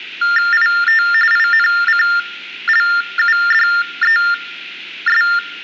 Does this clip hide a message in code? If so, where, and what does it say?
Yes: TTY/TDD text telephone tones (45.45 baud Baudot) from 0.2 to 5.4 s, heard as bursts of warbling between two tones, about 400 Hz shift, 1600 Hz centre. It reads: IT INCLUDES